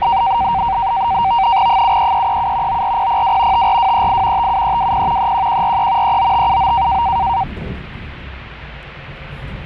NAVTEX (SITOR-B), 100 baud, 170 Hz shift, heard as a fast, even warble, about 860 Hz centre, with the noise inside a bus. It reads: 73337 94002 54238 57320 31143 39579